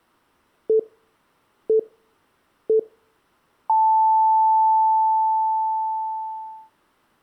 Radio time signal (three low pips and a long one an octave up, as on NHK), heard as pips.